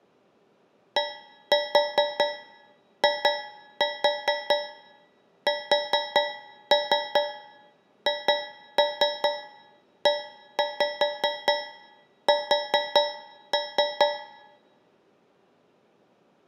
Tap code, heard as taps on a metal pipe, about 5 knocks a second, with room echo. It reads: DISHES